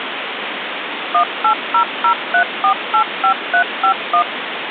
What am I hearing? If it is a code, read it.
DTMF, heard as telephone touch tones, dialled by machine, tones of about 90 ms, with phone line noise. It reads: 18003485351